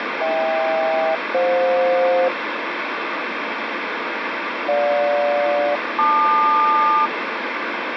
Aircraft SELCAL, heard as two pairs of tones, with radio static. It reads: HK-FJ GJ-LQ